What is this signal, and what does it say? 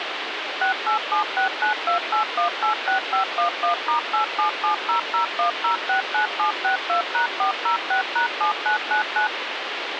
DTMF, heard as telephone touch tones, dialled by machine, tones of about 110 ms, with phone line noise. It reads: 6876928186511*877001069762#406#7999